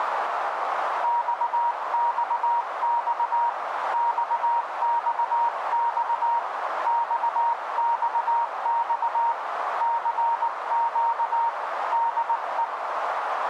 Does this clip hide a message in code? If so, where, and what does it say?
Yes: Morse code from 1.0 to 12.7 s, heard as a keyed tone, hand-sent with a paddle, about 19 wpm, 940 Hz, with radio static and a narrow filter. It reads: XXX XXX XXX CQ DE